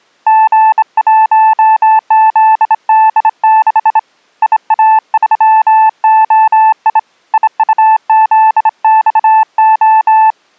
Morse code, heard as a keyed tone, hand-sent with a straight key, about 26 wpm, 880 Hz. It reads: G1ZD6 IA3OI IUZXO